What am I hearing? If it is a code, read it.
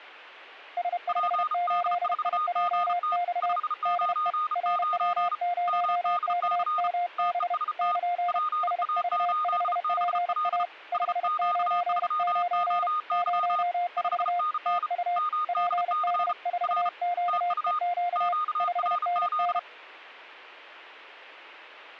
Morse code, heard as two keyed tones. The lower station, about 31 wpm, 700 Hz: S58IJX DE RW0KMB <KN> SV5PA 599 04 TU PD4QEQ 5NN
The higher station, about 34 wpm, 1230 Hz: PD4GT 599 MDC TEST PA8BL SQ3OY 5NN MDC R TU QRZ